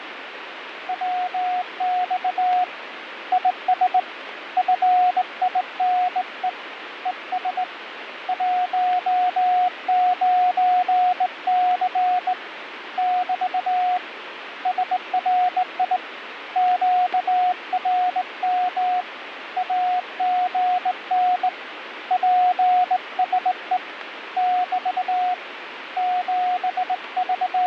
Morse code, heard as a keyed tone, hand-sent with a straight key, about 19 wpm, 730 Hz, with radio static and fading. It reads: WX IS FINE ES 19C <BT> SRI QRM AGN PSE <BT> …